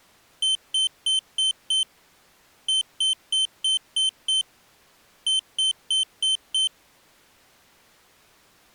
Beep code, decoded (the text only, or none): 5-6-5